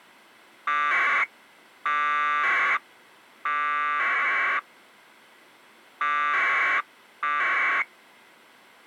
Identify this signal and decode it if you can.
Packet radio (AX.25, as in APRS), 1200 baud, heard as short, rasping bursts.